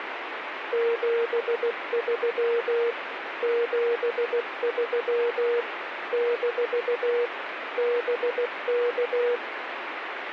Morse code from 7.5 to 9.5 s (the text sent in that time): BK